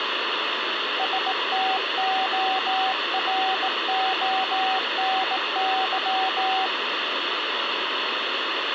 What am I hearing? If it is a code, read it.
Morse code (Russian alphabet), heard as a keyed tone, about 18 wpm, 760 Hz, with radio static and room echo. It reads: СТОРОНЫ